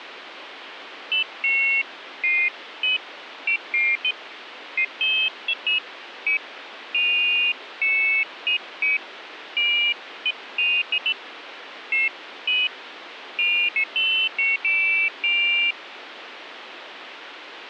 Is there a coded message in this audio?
No, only pairs of high tones at irregular times, with phone line noise.